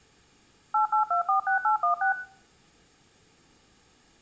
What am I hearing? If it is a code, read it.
DTMF, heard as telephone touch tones, dialled by machine, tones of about 110 ms, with room echo. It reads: 88246816